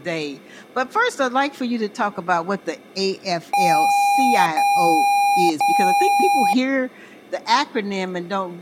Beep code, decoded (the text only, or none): 3 long